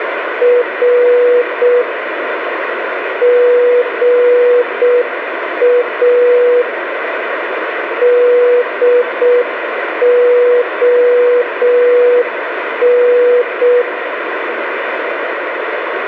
Morse code, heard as a keyed tone, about 6 wpm, 490 Hz, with radio static and room echo. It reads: R GA DON